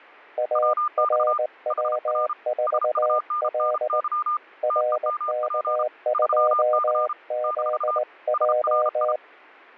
Morse code, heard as two keyed tones. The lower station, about 19 wpm, 610 Hz: ARW4L RK2ZJ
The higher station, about 33 wpm, 1210 Hz: WX HR SUNNY TEMP 3C - SRI